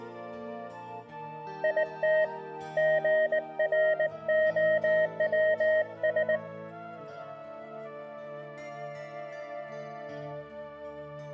Morse code, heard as a keyed tone, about 19 wpm, 620 Hz, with room echo. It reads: IT GROWS